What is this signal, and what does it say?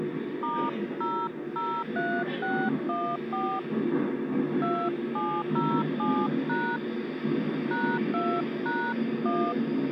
DTMF, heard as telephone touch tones, dialled by hand, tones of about 270 ms, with the noise inside a subway train. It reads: *003614 2707# #2#1